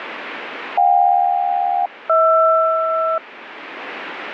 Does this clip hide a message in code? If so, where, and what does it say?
Yes: aircraft SELCAL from 0.8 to 3.2 s, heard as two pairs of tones, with radio static. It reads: JK-HR